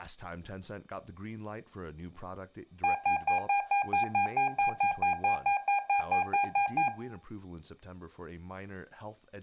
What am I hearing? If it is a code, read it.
Evenly repeated beeps, with room echo and speech in English. There is no code.